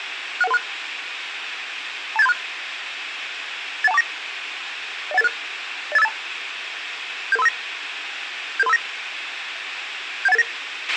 Five-tone selective call (EIA), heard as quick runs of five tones, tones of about 30 ms, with radio hiss and a squelch burst at the end. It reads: 61136 28736 81249 01886 08582 77359 77359 71889